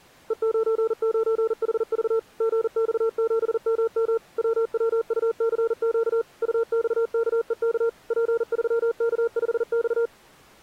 Morse code, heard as a keyed tone, machine-sent, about 40 wpm, 460 Hz. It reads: E99HV GX7MM WWUCQ UXKEK P3K5X